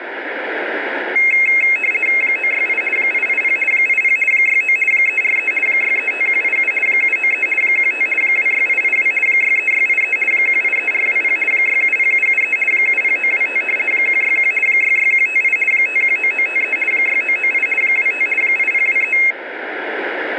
RTTY (50 baud, 450 Hz shift), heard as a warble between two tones, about 2350 Hz centre, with radio static. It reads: 968 880 80 69 343 635187 793 15 26882 63683 183420 670773 70925 161 66158 519953 6998 25 8023